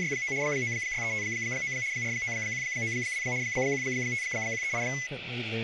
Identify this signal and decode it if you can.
RTTY (75 baud, 170 Hz shift), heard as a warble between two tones, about 2100 Hz centre, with radio static and speech in English. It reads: … 96359 49192 15138